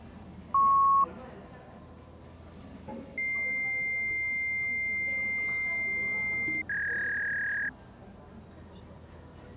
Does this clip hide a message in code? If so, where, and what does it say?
Yes: fax machine handshake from 0.5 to 7.7 s, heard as a beep, a long tone and a warble, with the noise of a cafe.